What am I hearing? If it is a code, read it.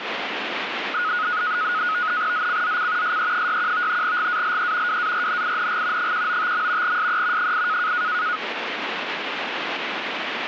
NAVTEX (SITOR-B), 100 baud, 170 Hz shift, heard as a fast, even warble, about 1360 Hz centre, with radio static. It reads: ZCZC SE61 GALE WARNING 195. SE 8